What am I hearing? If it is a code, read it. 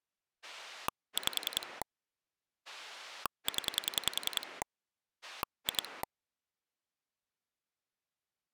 Pulse dialling, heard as a rotary dial, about 10 pulses a second. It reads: 5 0 2